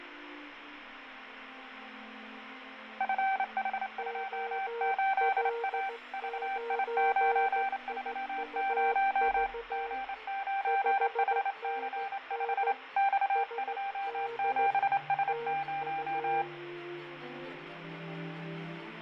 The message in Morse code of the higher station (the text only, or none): FH28A VI930 G9HC5 X27S0